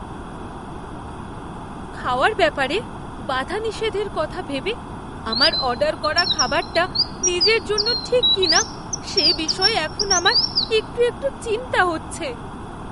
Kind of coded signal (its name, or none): none